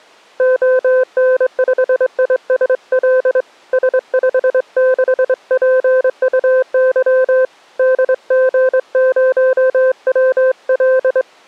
Morse code, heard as a keyed tone, hand-sent with a straight key, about 23 wpm, 520 Hz. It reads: ON5ISL S56PUY DG0WL